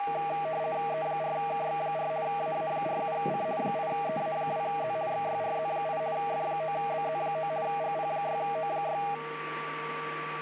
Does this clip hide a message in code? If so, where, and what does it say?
Yes: RTTY (50 baud, 170 Hz shift) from 0.0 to 9.2 s, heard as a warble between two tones, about 720 Hz centre, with radio static and a steady whistle near 1160 Hz. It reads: E4KX4 AA47C 8EA2Z XYRZ8 F9BZ9 GP6O6